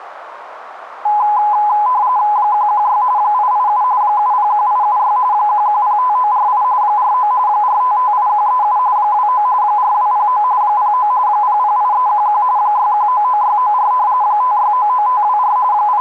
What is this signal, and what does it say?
RTTY (45.45 baud, 170 Hz shift), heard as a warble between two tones, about 920 Hz centre, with radio static. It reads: 116 887 701876 1105948 49 4558137 29 4209 09 008311 6199694 5699524 …